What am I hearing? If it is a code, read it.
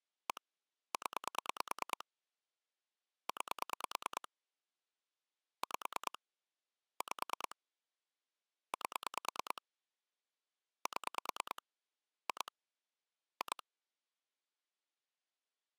Pulse dialling, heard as clicks on a phone line, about 9 pulses a second. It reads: 1 0 9 5 5 8 7 2 2